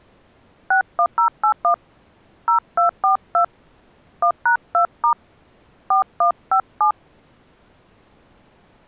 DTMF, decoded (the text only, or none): 61081 0242 1#2* 4157